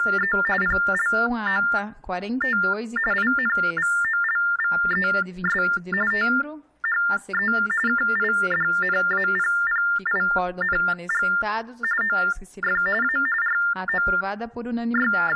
TTY/TDD text telephone tones (45.45 baud Baudot), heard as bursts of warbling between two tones, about 400 Hz shift, 1600 Hz centre. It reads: … PLOT INVOLVES THE KIDNAPPING OF A …